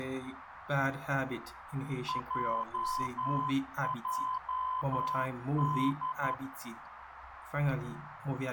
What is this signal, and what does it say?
Morse code, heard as a keyed tone, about 11 wpm, 1020 Hz, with radio static and a narrow filter. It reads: JJD